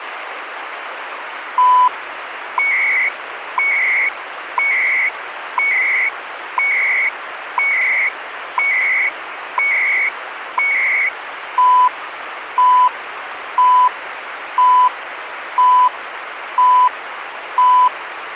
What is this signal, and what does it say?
Radio time signal (CHU, Canada), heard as beeps and data bursts, one a second, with radio static.